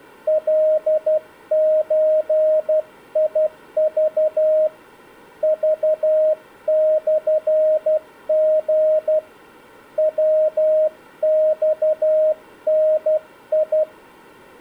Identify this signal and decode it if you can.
Morse code (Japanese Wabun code), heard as a keyed tone, hand-sent with a paddle, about 12 wpm, 620 Hz. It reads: カゾク クモリ ヤマダ